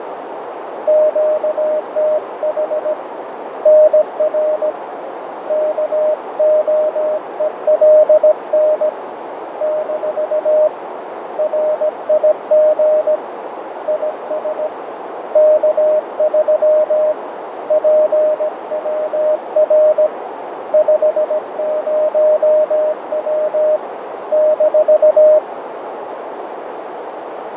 Morse code, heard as a keyed tone, hand-sent with a paddle, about 17 wpm, 610 Hz, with radio static, fading and a narrow filter. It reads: QTH NR KOELN - RIG IS K3 PWR 50W -